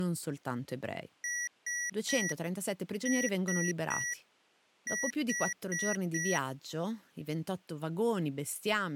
Beep code, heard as beeps from a small speaker, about 1950 Hz, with speech in Italian. 3-3-4. In Phoenix BIOS tables: video failure.